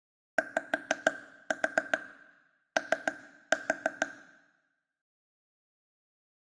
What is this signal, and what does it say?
Tap code, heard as taps on a table, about 6 knocks a second, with room echo. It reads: YO